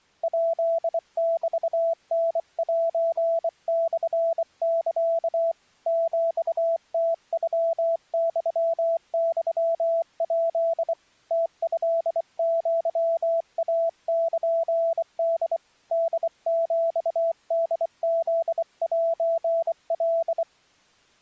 Morse code (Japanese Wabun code), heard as a keyed tone, hand-sent with a bug key, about 24 wpm, 660 Hz. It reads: ヱメタセモサ ヒムノユユヱ ムトアイルホ ホヒホフセカ